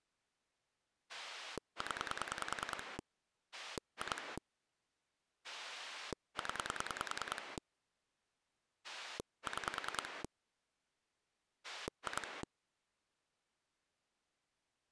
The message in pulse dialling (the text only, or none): 0 2 0 6 2